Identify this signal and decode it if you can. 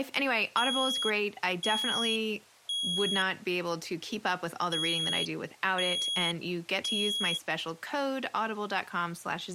Alarm pattern, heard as an alarm's beeps, played twice, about 3300 Hz, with speech in English. Temporal three. Smoke or fire, evacuate.